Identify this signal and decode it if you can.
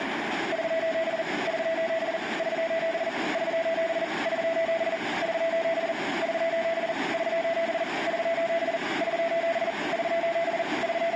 Morse code, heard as a keyed tone, hand-sent with a paddle, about 40 wpm, 660 Hz, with radio static, a narrow filter and room echo. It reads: <SOS> <SOS> <SOS> <SOS> <SOS> <SOS> <SOS> <SOS> <SOS> <SOS> <SOS> …